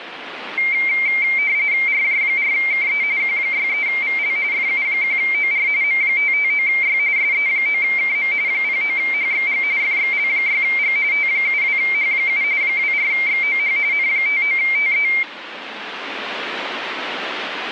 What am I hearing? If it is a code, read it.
RTTY (45.45 baud, 170 Hz shift), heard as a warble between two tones, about 2200 Hz centre, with radio static. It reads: RJ4KE Q63VL FU1OR M559Y SE9KM 09HXG FXL6G T72H7 24XOH N59TE